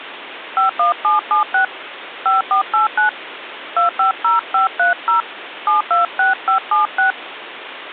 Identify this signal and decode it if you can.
DTMF, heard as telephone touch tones, dialled by hand, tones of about 130 ms, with phone line noise. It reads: 51776 5489 250530 726576